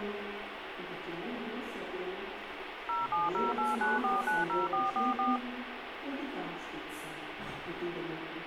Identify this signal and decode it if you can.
DTMF, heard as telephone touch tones, dialled by machine, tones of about 170 ms, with phone line noise. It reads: 07089490444